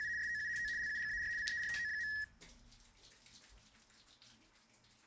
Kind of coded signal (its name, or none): RTTY